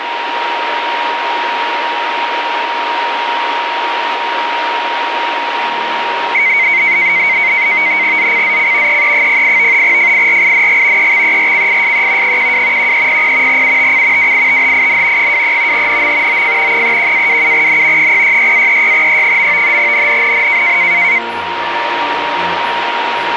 NAVTEX (SITOR-B), 100 baud, 170 Hz shift, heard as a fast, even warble, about 2150 Hz centre, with radio static and a steady whistle near 940 Hz. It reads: ZCZC EE08 FIRING EXERCISE 12 1300 UTC WITHIN 23 NM OF 31-27N 066-36E. NNNN